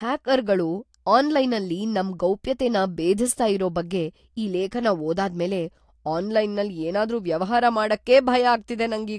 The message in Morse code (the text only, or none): none